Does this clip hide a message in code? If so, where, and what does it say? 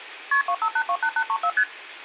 Yes: multi-frequency trunk signalling (R1, as on North American trunks) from 0.3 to 1.6 s, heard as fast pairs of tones, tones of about 70 ms, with room echo. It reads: KP 25828834 ST